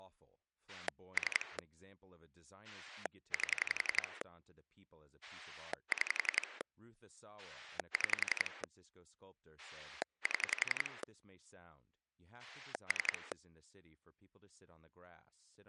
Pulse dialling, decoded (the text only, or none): 3 8 6 6 7 3